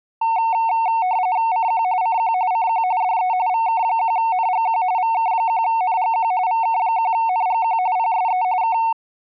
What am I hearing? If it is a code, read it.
RTTY (45.45 baud, 170 Hz shift), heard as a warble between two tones, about 820 Hz centre. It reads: CQ CQ CQ DE VK1NGQ VK1NGQ VK1NGQ PSE K